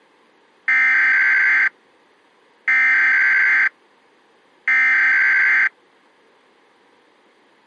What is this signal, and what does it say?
Emergency Alert System (SAME) tones (header bursts), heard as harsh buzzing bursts, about 520.83 baud.